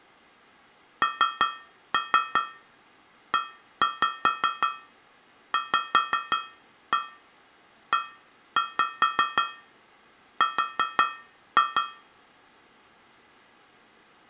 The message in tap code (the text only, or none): NEVER